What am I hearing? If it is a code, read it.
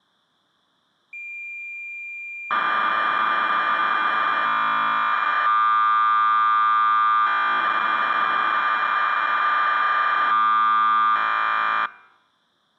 Cassette data (Kansas City type), 1200 baud, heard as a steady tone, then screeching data.